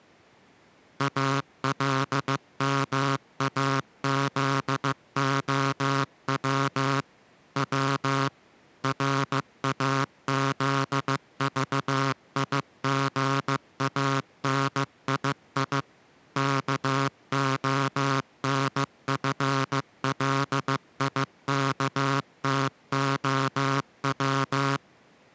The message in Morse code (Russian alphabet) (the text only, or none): АЛМАЗОВ В РАЗЖИГАНИИ КОНФЛИКТОВ